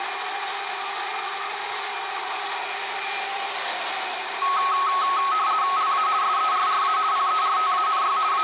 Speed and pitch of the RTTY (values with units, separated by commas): 50 baud, 170 Hz shift, 1190 Hz centre